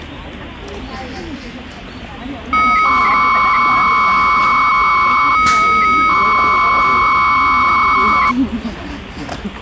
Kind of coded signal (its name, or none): 300-baud modem data